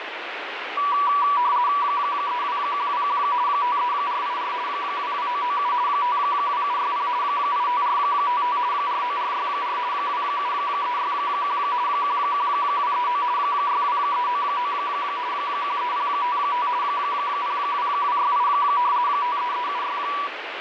RTTY (50 baud, 170 Hz shift), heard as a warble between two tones, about 1060 Hz centre, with radio static. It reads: 32121 53484 22997 52760 85455 49464 27361 11239 62399 13055 02268 53376